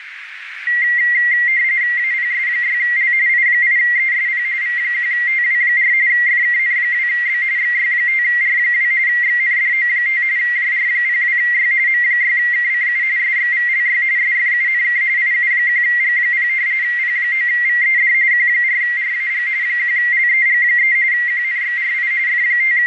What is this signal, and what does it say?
RTTY (45.45 baud, 170 Hz shift), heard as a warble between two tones, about 2000 Hz centre, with radio static and a narrow filter. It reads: APS6L I8ESP V1TW4 FKN2B XY5R2 XNDO5 JR02Y M6KCU SXVLY SFUNK IU1G0 P9VED Q4RAG 1LEG3 QNXRI …